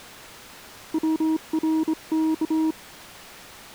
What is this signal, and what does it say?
Morse code (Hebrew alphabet), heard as a keyed tone, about 26 wpm, 320 Hz. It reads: צרך